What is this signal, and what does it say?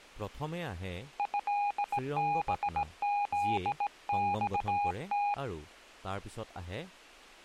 Morse code (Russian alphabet), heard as a keyed tone, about 17 wpm, 820 Hz, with speech in Assamese. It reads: ЭБЗЬТ